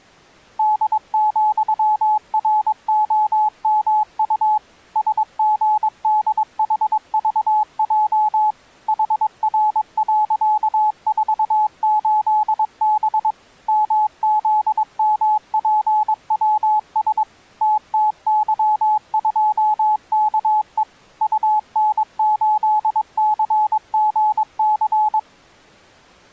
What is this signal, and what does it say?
Morse code, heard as a keyed tone, machine-sent, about 22 wpm, 850 Hz. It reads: D,ROMU SGDHVJ HR.48B MZMPWS TTY2KE UN8CGC